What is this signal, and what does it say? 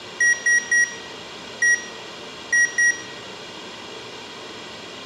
Beep code, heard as beeps from a small speaker, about 1900 Hz, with room echo. 3-1-2. In Phoenix BIOS tables: DMA register failure.